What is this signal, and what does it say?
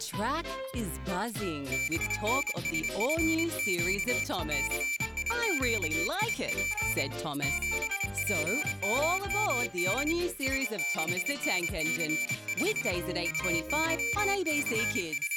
Morse code, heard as a high beeper, hand-sent with a paddle, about 26 wpm, 2350 Hz. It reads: BNSFQ CIQIP 7PMMD S6NC5 …